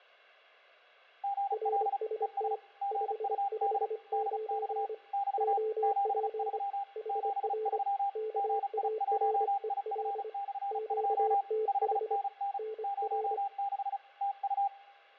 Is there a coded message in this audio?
Yes: Morse code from 1.2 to 14.7 s, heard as two keyed tones, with fading. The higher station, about 35 wpm, 800 Hz: GL ES GUD DX <BT> 73 73 GI1IF/2 5NN 06 TU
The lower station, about 25 wpm, 440 Hz: RST 559 OP HR KAREL QTH NR